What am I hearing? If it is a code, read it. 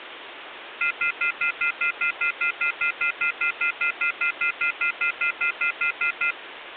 Telephone call progress tone (North American plan), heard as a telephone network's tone, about 1400, 2050, 2450, 2600 Hz, 0.1 s on and 0.1 s off, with phone line noise. Off-hook warning tone.